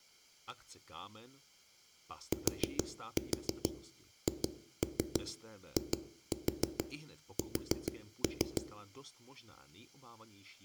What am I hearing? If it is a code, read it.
Tap code, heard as knocks on a wall, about 6 knocks a second, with room echo and speech in Czech. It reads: THIS